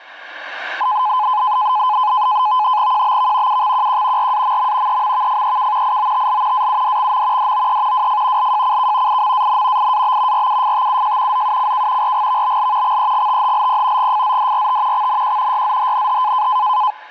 NAVTEX (SITOR-B), 100 baud, 170 Hz shift, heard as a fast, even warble, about 930 Hz centre. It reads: QBV UXQQ RAMM EMVFEK IOTL AUDXM DOE WF LJCK IMAN IAB RUFTUJ ZUCK RGVBL XEGTHLP GFZDRT XNQ YZHNH